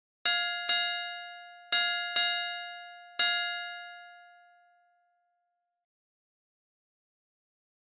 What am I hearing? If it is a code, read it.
Ship's bell, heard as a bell. 5. Five half-hours of the watch have passed.